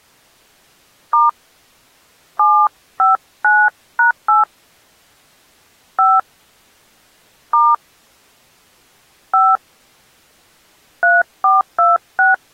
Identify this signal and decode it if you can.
DTMF, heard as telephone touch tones, dialled by hand, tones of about 210 ms. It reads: * 759#8 5 * 5 3426